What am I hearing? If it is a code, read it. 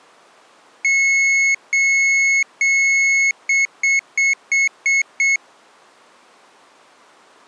Beep code, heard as a piezo beeper, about 2200 Hz. 3 long, 6 short.